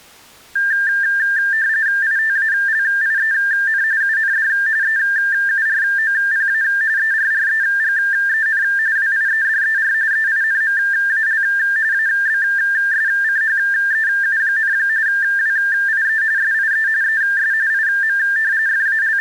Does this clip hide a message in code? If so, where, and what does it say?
Yes: RTTY (45.45 baud, 170 Hz shift) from 0.6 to 19.2 s, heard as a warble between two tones, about 1700 Hz centre. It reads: ITALIEN UND EUROPA ERREGEN WIEDER EINMAL ABSCHEU, WIE SIE ES IM …